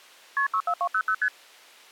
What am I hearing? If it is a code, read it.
Multi-frequency trunk signalling (R1, as on North American trunks), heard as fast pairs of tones, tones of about 70 ms. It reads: KP 64200 ST